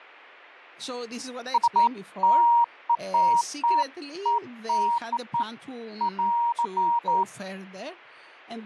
Beeps of irregular length, with speech in English. There is no code.